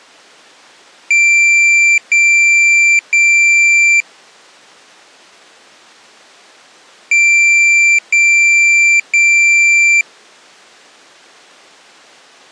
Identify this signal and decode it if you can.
Beep code, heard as a piezo beeper, played twice, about 2350 Hz. 3 long. In IBM BIOS tables: keyboard card error.